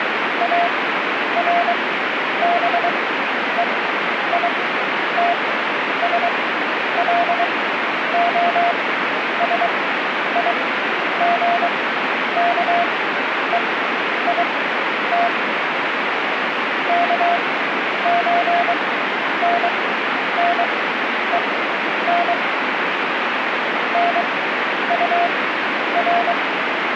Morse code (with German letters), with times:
0.4-15.3 ARBEITSLOSIGKEIT
16.9-22.3 KÖNNEN
23.9-26.3 NUR

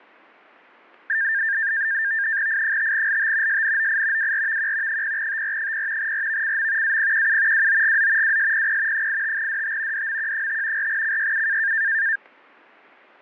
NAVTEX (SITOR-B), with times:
2.5-3.6 I5LT
3.5-4.3 SNOI
4.2-5.0 WRVQ
4.9-6.1 0TR0
6.0-7.0 RVCM
6.8-7.7 APQU
7.5-8.4 WOGZ
8.2-9.1 WSPP
8.9-10.1 85DT
9.9-10.9 DMQ5
10.8-11.7 4CYU

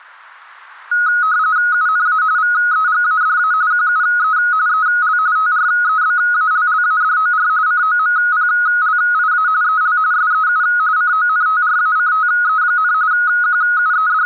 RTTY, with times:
1.7-2.2 UNA
2.4-3.5 VEGADA
3.7-4.4 QUE
4.7-5.2 EL
5.4-7.5 TREBALLADOR
7.7-9.5 COMPLIA
9.6-10.0 EL
10.1-10.6 SEU
11.0-12.9 CONTRACTE,
13.1-14.3 …

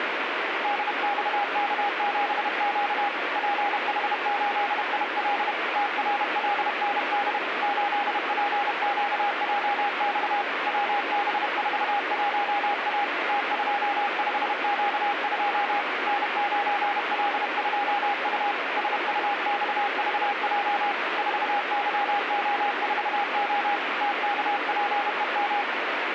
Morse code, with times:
0.6-3.1 DXK7Q
3.4-5.5 PH8IL
5.8-7.4 TRLND
7.6-10.4 8PQJX
10.7-13.0 WB41A
13.3-15.8 T25Q2
16.1-18.5 N9L2U
18.8-20.9 SUXVJ
21.2-23.8 4YO4O
24.0-25.6 TKPEM

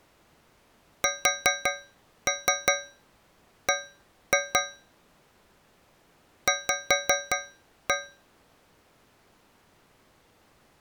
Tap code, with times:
1.0-4.6 SB
6.5-7.9 V

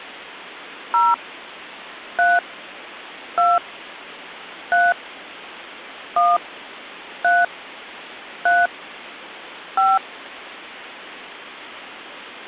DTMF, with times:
0.9-1.1 0
2.2-2.4 3
3.4-3.6 2
4.7-4.9 3
6.2-6.4 1
7.2-7.4 3
8.5-8.7 3
9.8-10.0 5

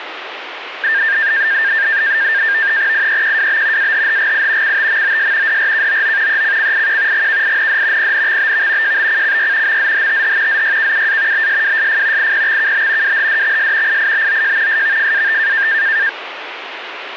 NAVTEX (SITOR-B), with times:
2.9-3.9 IEQWB
3.8-4.8 AHHGI
4.6-5.6 CTMOS
5.5-6.4 DRKOO
6.3-7.3 ECCIQ
7.1-8.1 GKIND
8.0-9.0 PNXBV
8.8-9.8 JBCCY
9.7-10.6 MZHTH
10.5-11.5 ZYKUA
11.3-12.3 BSWSF
12.2-13.2 IPXKB
13.0-14.0 WHDXS
13.9-14.8 IIBOJ
14.7-15.7 SVFAT

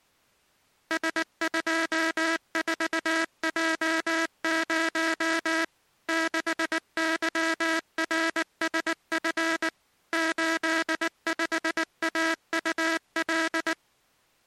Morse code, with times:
0.9-5.6 S24J0
6.1-9.7 6YRSF
10.1-13.7 85AUL

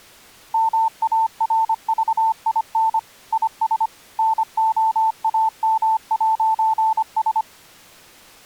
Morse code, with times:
0.5-3.0 MARVIN
3.3-3.9 IS
4.2-7.4 NOAM'S

